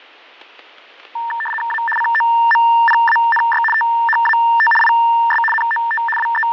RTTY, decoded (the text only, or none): A COMPANY THAT IS NOT …